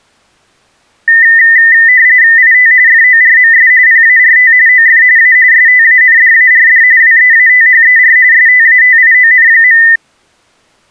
RTTY (45.45 baud, 170 Hz shift), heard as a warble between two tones, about 1900 Hz centre. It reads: IT FORMS PART OF A STANDARD WEATHER STATION.